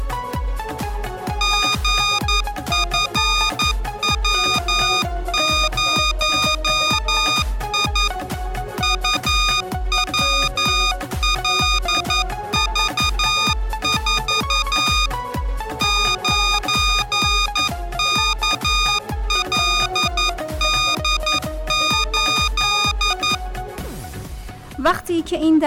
Morse code, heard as electronic beeps, machine-sent, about 11 wpm, 1230 Hz. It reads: GFW0I UWLV4 9KLD8